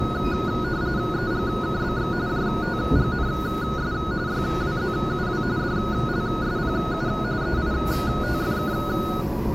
RTTY (45.45 baud, 170 Hz shift), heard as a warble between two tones, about 1360 Hz centre, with the noise inside a subway train. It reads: EGKBX JTGNS YWZUW DLSPU EITFK